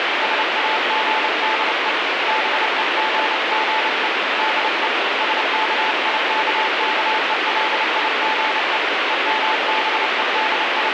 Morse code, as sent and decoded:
... .- --. -.. . / -... . --. --. . / -.. . / ... -.- .. -.- -.- . .-.. .. --. . / …
SAGDE BEGGE DE SKIKKELIGE …

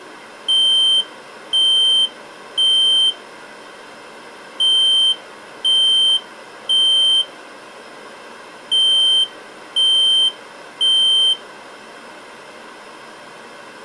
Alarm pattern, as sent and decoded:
3 beeps and a pause
temporal three

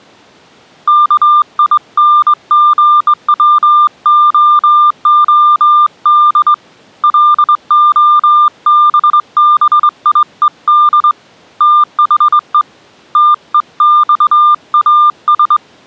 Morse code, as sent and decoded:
-.- .. -. --. .-- --- --- -.. / .-.. --- -... -... .. . -.. / - .... . / - . -..- .- ...
KINGWOOD LOBBIED THE TEXAS

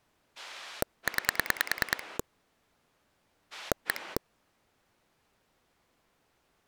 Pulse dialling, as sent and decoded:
9 / 1
9 1

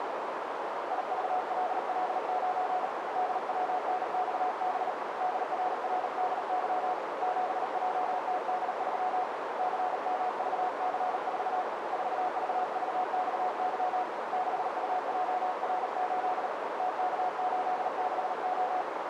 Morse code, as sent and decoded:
.. ...- .-.. .-.. ----. / -.. .-- -. -..- -... / -.. .-. .-. -.. -.-- / --... .--- - -.. ...-- / -.-. -- ...- -.-. ....- / ....- ...- ...- -..- -.-- / -.... ..- .--- .-. ---.. / - -.- ---.. -.... ---
IVLL9 DWNXB DRRDY 7JTD3 CMVC4 4VVXY 6UJR8 TK86O

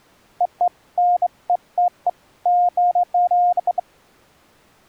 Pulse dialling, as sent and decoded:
none

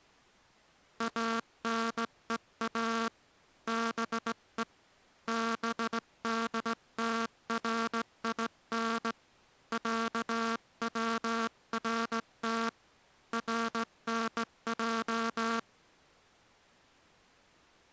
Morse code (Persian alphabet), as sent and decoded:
.- -. . .- / -... . / -... -.. - .-. .. -. / .-.- .-- .-. - / .-. -. .---
انها به بدترین صورت رنج

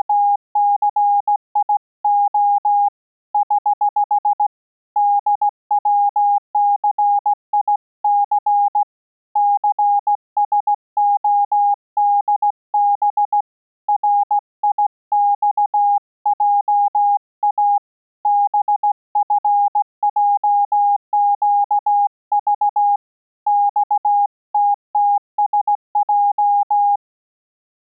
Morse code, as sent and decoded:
… / ........ / -.. .-- -.-. .. -.-. / -.-. ... --- -.. -... / .-. .. -..- .--- .- / -... ..-. .--- --.- ...- / -..- - - ... .---
… <HH> DWCIC CSODB RIXJA BFJQV XTTSJ

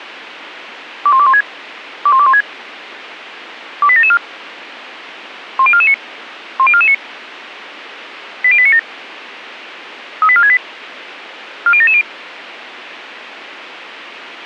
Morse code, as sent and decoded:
none

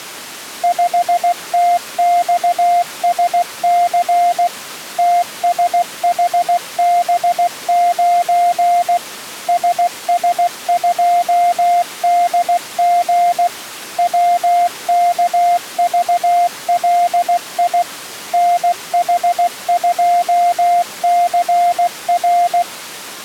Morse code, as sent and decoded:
..... - -..- ... -.-. / - ... .... -... ----. / ... ... ..--- -.. --. / .-- -.- ...- .-.. .. / -. .... ..--- -.-. .-.
5TXSC TSHB9 SS2DG WKVLI NH2CR

